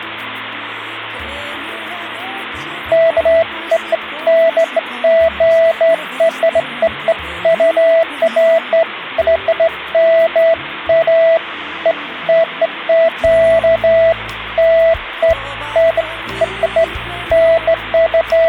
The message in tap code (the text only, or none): none